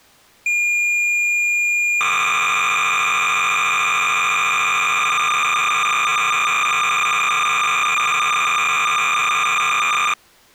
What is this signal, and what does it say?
Cassette data (Kansas City type), 300 baud, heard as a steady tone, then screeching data.